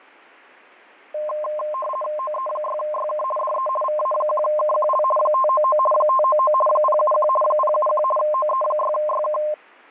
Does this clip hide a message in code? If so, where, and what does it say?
Yes: RTTY (50 baud, 450 Hz shift) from 1.1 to 9.5 s, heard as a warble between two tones, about 830 Hz centre, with fading. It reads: OE6YK DE VA1KQL 599 599 071 071 OE6YK